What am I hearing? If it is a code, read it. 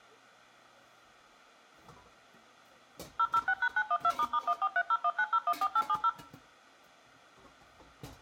DTMF, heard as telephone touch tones, dialled by machine, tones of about 60 ms, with kitchen noise. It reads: 006#912**143019014870